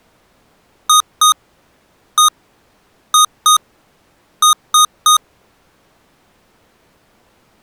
Beep code, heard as beeps from a small speaker, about 1240 Hz. 2-1-2-3. In Phoenix BIOS tables: ROM copyright notice check failure.